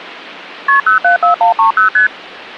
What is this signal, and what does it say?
Multi-frequency trunk signalling (R1, as on North American trunks), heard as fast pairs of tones, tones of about 120 ms. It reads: KP 074130 ST